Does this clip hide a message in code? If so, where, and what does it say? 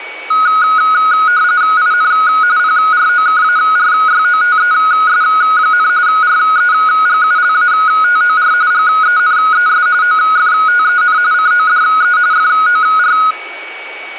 Yes: RTTY (45.45 baud, 170 Hz shift) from 0.3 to 13.3 s, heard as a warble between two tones, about 1360 Hz centre, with a steady whistle near 2260 Hz and room echo. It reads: IN PROKARYOTES, REGULATOR GENES OFTEN CODE FOR